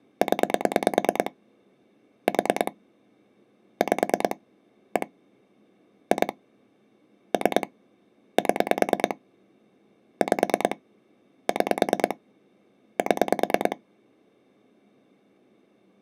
Pulse dialling, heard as clicks on a phone line, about 9 pulses a second. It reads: 0 4 5 1 2 3 7 5 6 7